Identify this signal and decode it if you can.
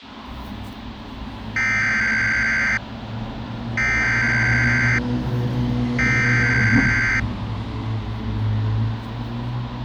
Emergency Alert System (SAME) tones (header bursts), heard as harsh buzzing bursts, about 520.83 baud, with the noise of a residential street.